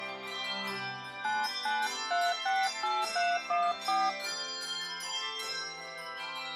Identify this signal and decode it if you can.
DTMF, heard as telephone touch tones, dialled by hand, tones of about 220 ms. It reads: 99368314